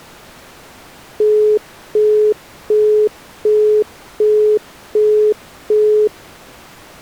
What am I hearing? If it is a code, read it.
Telephone call progress tone (as in the UK, Australia and similar networks), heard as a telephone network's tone, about 420 Hz, 0.375 s on and 0.375 s off. Busy tone.